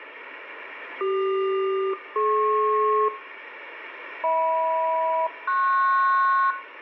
Aircraft SELCAL, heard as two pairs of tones, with radio static and room echo. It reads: CQ-DP HM-PS